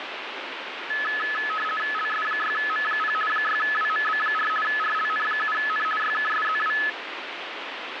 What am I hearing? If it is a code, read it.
RTTY (50 baud, 450 Hz shift), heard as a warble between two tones, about 1500 Hz centre, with radio static. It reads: LS6M0 6WMB4 RLN7N YKSZW